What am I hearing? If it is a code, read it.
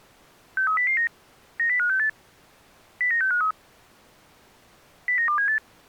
Five-tone selective call (CCIR), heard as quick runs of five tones, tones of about 100 ms. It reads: 63009 90568 09653 09278